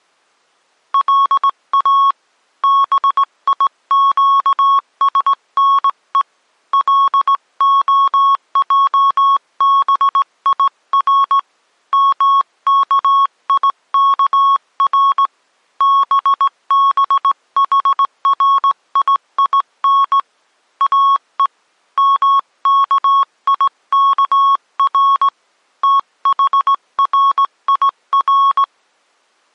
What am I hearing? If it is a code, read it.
Morse code (Hebrew alphabet), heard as a keyed tone, hand-sent with a straight key, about 18 wpm, 1100 Hz. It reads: לא ביקשנו להעביר מכיכר בבחריין או מכיכר תחריר